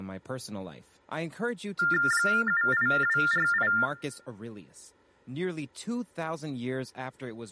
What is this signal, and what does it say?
TTY/TDD text telephone tones (45.45 baud Baudot), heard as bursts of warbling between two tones, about 400 Hz shift, 1600 Hz centre, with speech in English. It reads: 78248